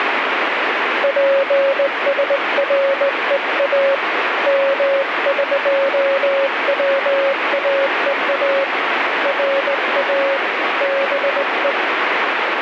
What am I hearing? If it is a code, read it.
Morse code (Persian alphabet), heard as a keyed tone, hand-sent with a straight key, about 19 wpm, 550 Hz, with heavy radio static. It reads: پسرها مقواها را به